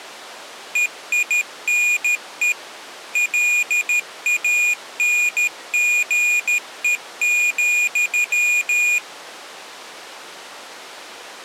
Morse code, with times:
0.8-2.5 EINE
3.2-9.0 LANGE,

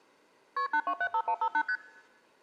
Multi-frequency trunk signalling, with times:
0.6-0.7 KP
0.7-1.6 8275158
1.7-1.8 ST

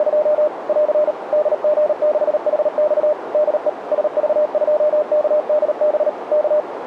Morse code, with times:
0.0-0.5 …
0.7-1.1 <AR>
1.3-3.1 DG6HX
3.3-3.7 DE
3.9-6.1 SV2KDB
6.3-6.6 K

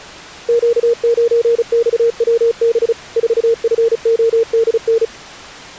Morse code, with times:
0.5-2.9 Q9XWB
3.2-5.0 4FODN

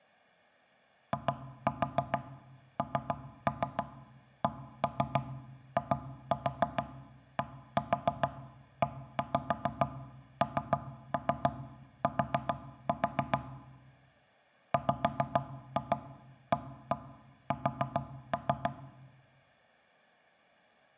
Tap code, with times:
1.1-13.4 INCIDENT
14.7-18.7 WAS

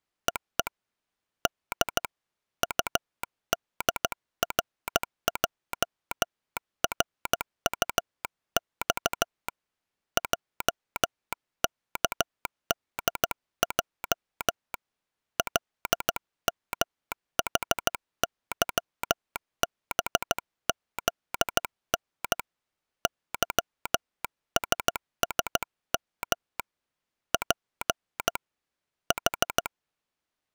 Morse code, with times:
0.3-0.7 EE
1.5-2.0 D
2.6-9.5 UDRJRUX
10.2-14.7 JKDJ
15.4-22.4 LMHYBZN
23.1-26.6 YSSM
27.3-28.4 P
29.1-29.7 H

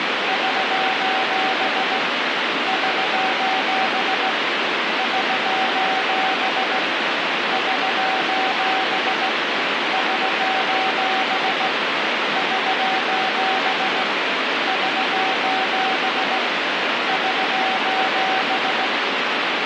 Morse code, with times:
0.3-2.0 <SOS>
2.7-4.3 <SOS>
5.0-6.8 <SOS>
7.5-9.3 <SOS>
9.9-11.7 <SOS>
12.4-14.0 <SOS>
14.7-16.4 <SOS>
17.1-18.9 <SOS>

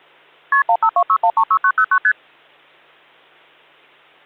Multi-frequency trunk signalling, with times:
0.5-0.6 KP
0.7-2.0 1526136909
2.0-2.1 ST

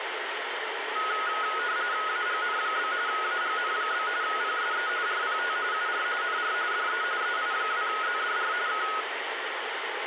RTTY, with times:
2.1-2.9 AGN?
3.1-4.1 AGN?
4.2-4.9 PSE
5.1-5.6 RPT
5.7-6.1 UR
6.2-6.5 NR
6.7-7.0 DE
7.2-8.5 EI2ZDR
8.7-8.9 K

